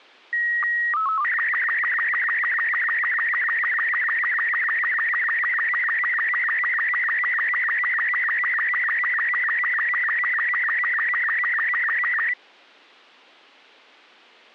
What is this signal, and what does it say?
SSTV (slow-scan television), Robot 36, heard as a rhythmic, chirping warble.